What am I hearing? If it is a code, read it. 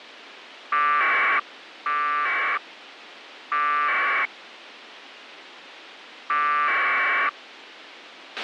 Packet radio (AX.25, as in APRS), 1200 baud, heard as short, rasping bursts, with a squelch burst at the end.